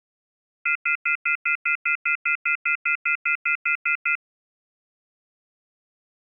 Telephone call progress tone (North American plan), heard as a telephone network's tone, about 1400, 2050, 2450, 2600 Hz, 0.1 s on and 0.1 s off. Off-hook warning tone.